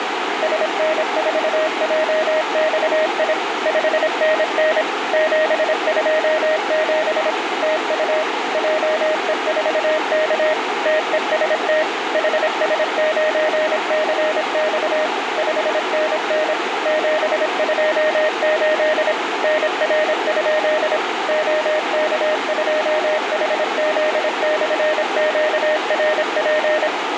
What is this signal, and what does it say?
Morse code, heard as a keyed tone, machine-sent, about 26 wpm, 620 Hz, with radio static, a narrow filter and room echo. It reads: SN4JXI 5NN 727 TU JE4K TEST HS9CX 5NN 728 NR? OK2HZ/QRP